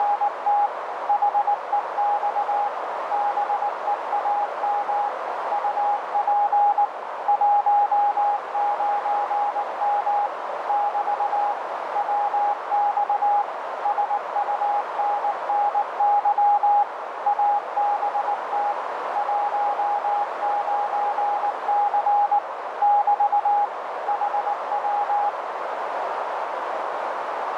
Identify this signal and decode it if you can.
Morse code, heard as a keyed tone, machine-sent, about 19 wpm, 820 Hz, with heavy radio static and a narrow filter. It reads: … HEX BEAM UP 19M <BT> WX SUNNY ABT 19C <BT> HW